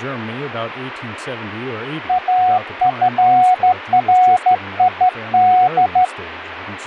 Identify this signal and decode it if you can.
Morse code (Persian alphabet), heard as a keyed tone, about 14 wpm, 740 Hz, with radio static and speech in English. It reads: افرید